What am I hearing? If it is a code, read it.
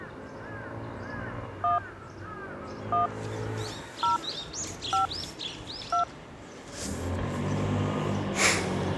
DTMF, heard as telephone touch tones, dialled by hand, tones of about 110 ms, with the noise of a residential street. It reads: 1 1 0 5 2